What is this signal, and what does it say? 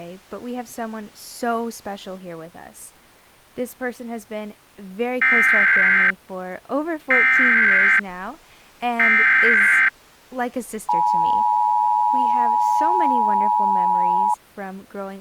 Emergency Alert System (SAME) tones (header bursts, then the 853 and 960 Hz attention tone), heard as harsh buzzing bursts, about 520.83 baud, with speech in English.